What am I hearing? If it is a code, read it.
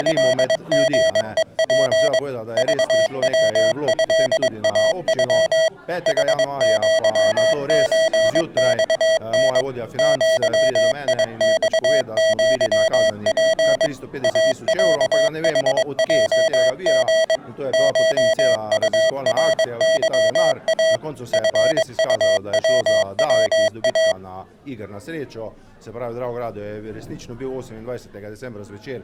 Morse code (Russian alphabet), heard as electronic beeps, machine-sent, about 22 wpm, 650 Hz. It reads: … ЖВЭАЮ ХЪЧЬН ЪИЬЪП АЯХЙГ ШУРЫА ФУВВА